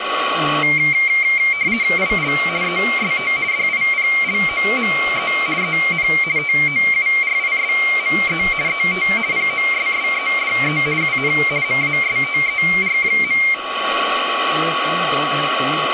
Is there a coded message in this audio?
Yes: RTTY (50 baud, 170 Hz shift) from 0.6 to 13.5 s, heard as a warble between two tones, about 2200 Hz centre, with radio static, a steady whistle near 1120 Hz, room echo and speech in English. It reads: IL EST DIPLOME EN TOURISME ET POSSEDE UN MASTER.